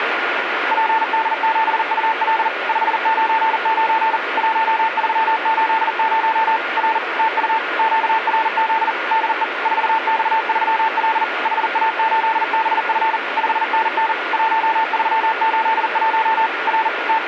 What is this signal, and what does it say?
Morse code, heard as a keyed tone, machine-sent, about 40 wpm, 890 Hz, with radio static. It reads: PD7UL 599 1380 R TU QRZ DE 4X3L HA8BF 5NN 1381 R …